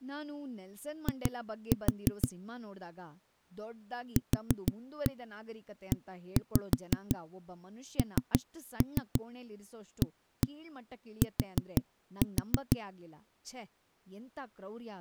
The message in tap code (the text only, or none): I QENAT